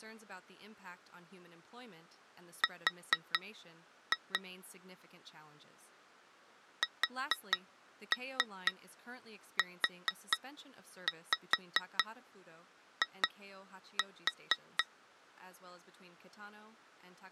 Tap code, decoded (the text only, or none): R SUI